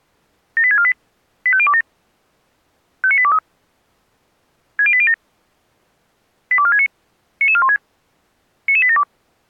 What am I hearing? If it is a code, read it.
Five-tone selective call (ZVEI), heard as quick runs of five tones, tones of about 70 ms. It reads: 78648 85027 59823 60807 82469 99416 99872